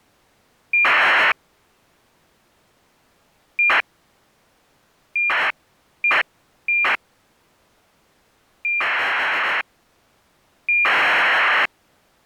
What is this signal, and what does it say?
ACARS aircraft data, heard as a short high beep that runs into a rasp, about 2400 baud.